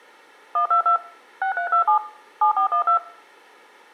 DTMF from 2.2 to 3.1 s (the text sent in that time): 7412